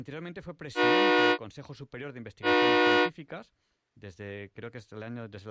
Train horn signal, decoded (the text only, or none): 2 short